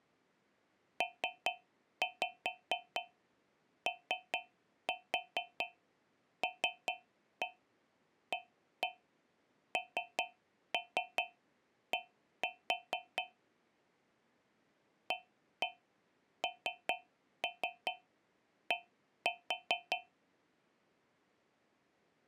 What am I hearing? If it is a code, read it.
Tap code, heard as taps on a metal pipe, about 4 knocks a second. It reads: POLAND AND